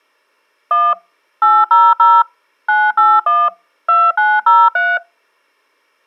DTMF, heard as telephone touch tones, dialled by machine, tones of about 220 ms. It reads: 1 800 981 2903